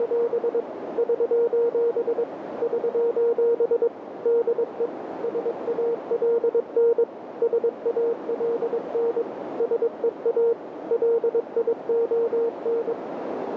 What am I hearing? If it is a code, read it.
Morse code, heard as a keyed tone, machine-sent, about 22 wpm, 470 Hz, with radio static and a narrow filter. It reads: … <SOS> <SOS> DE SALN SALN SEA LION